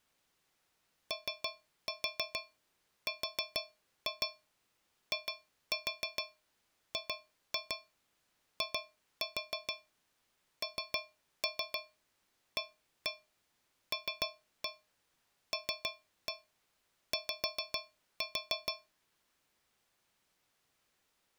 Tap code, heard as taps on a metal pipe, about 6 knocks a second. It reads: ORIGINALLY